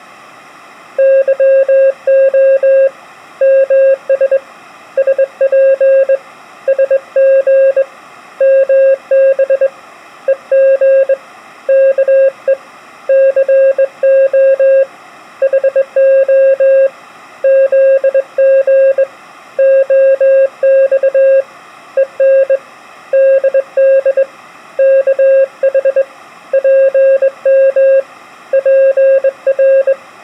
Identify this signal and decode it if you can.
Morse code (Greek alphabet), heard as a keyed tone, hand-sent with a straight key, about 21 wpm, 540 Hz. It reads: ΥΟ ΜΣ ΣΠ ΣΓ ΜΒ ΕΓ ΚΕ ΘΟ ΗΟ ΖΓ ΟΞ ΕΝ ΔΔ ΚΗ ΠΜ ΠΡ